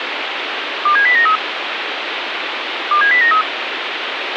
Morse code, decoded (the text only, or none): none